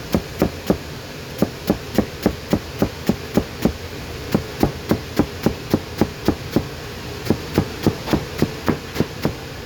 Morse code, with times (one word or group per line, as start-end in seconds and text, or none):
none